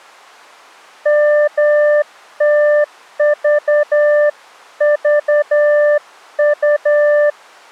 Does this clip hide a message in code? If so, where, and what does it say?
Yes: Morse code (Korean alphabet) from 1.0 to 7.4 s, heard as a keyed tone, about 10 wpm, 590 Hz. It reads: 멀리